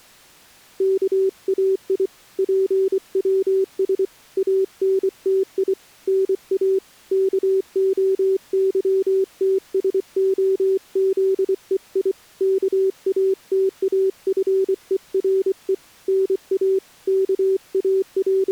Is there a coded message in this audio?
Yes: Morse code (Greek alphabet) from 0.7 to 18.5 s, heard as a keyed tone, hand-sent with a paddle, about 24 wpm, 380 Hz. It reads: ΚΑΙ ΠΩΣ ΑΝΤΙ ΝΑ ΚΟΥΤΣΟΖΕΙ ΚΑΤΑΦΕΡΕ ΝΑ …